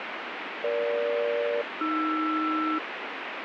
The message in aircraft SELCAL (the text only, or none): EG-AR